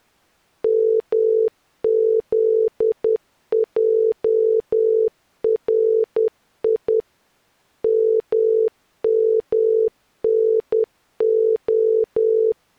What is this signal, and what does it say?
Morse code (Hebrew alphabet), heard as a keyed tone, machine-sent, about 10 wpm, 440 Hz. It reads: מזערי ממנה